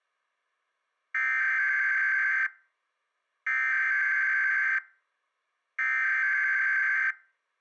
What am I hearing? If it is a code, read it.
Emergency Alert System (SAME) tones (header bursts), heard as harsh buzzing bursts, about 520.83 baud.